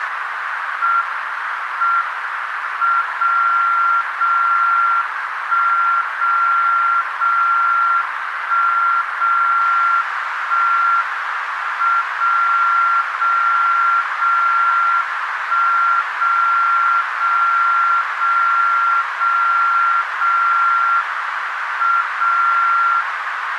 Radio time signal (WWVB), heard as a tone whose level steps once a second, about 1380 Hz, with radio static and a narrow filter. The time is 10:15 UTC. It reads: M M 0 0 1 0 0 1 0 1 M 0 0 0 1 0 0 0 0 0 M 0